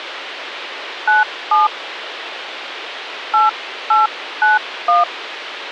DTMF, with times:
1.1-1.7 97
3.3-5.0 8891

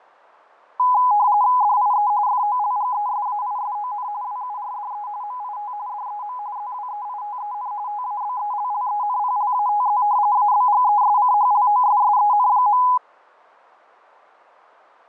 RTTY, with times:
1.6-2.1 DIE
2.3-4.1 FOLGESAISON
4.2-5.1 WURDE
5.2-5.7 MIT
5.9-6.4 DEM
6.6-7.7 ZWEITEN
7.9-10.0 TABELLENPLATZ
10.4-12.8 ABGESCHLOSSEN.

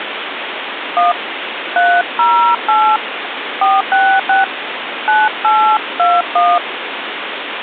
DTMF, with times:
1.0-1.1 1
1.8-3.0 308
3.6-4.4 466
5.1-6.6 9821

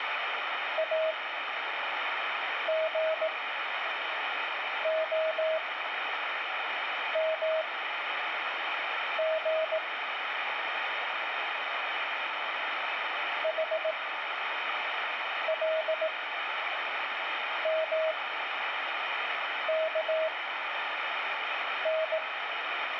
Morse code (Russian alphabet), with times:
0.8-9.8 АГОМГ
13.4-22.2 ХЛМКН

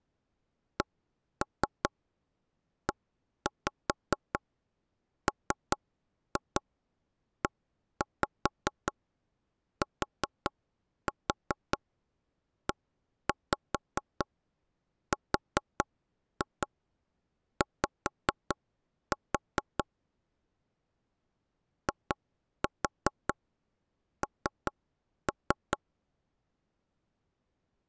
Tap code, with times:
0.8-19.8 CEMETERY
21.9-25.8 IN

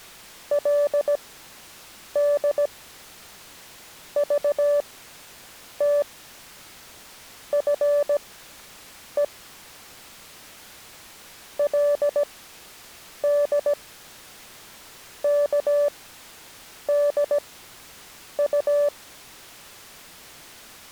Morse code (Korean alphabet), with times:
0.5-9.2 그러나
11.6-18.9 그의

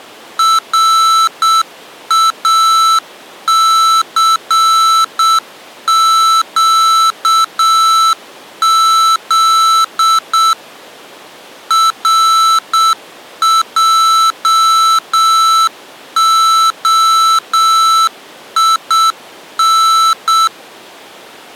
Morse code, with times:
0.4-10.5 RACQZ
11.7-20.5 RJOIN

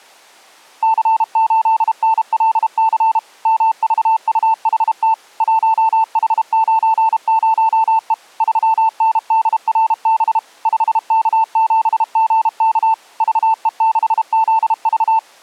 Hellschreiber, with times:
none

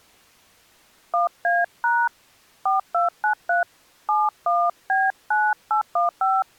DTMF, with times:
1.1-2.1 1A#
2.7-3.6 4293
4.1-6.4 71B9815

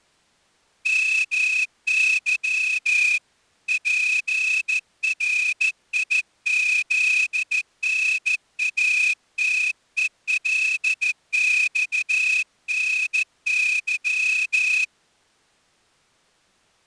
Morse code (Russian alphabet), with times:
0.9-3.2 МЫ
3.7-14.8 ПРИЗНАТЕЛЬНЫ

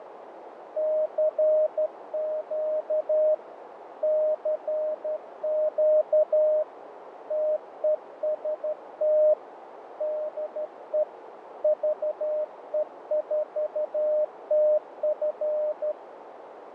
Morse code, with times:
0.8-3.3 CQ
4.0-6.6 CQ
7.3-9.3 TEST
10.0-11.0 DE
11.6-15.9 VE4TF

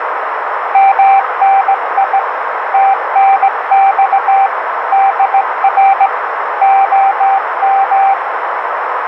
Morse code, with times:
0.7-2.2 MNI
2.7-4.5 TNX
4.9-6.1 DR
6.6-8.1 OM

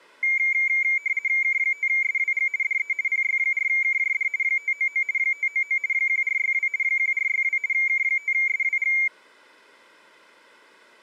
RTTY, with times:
1.4-2.5 K5SWG
2.6-2.9 DE
3.1-4.3 PY4KJD
4.4-5.0 599
5.2-5.8 599
5.9-6.7 1462
6.8-7.6 1462
7.7-8.9 K5SWG

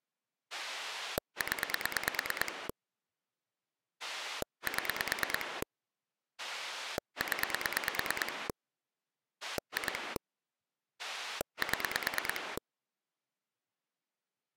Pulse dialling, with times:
0.5-2.7 0
4.0-5.6 7
6.4-8.5 0
9.4-10.2 2
11.0-12.6 7

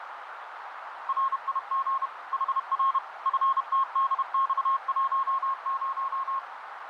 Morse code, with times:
1.1-2.1 RIG
2.3-3.0 HR
3.3-6.4 FTDX10

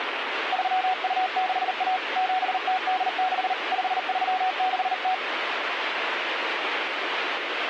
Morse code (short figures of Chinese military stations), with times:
0.5-2.0 3261
2.2-3.5 7086
3.7-5.1 5360

